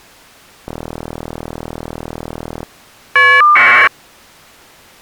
Caller ID data burst, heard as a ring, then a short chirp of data, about 1200 baud.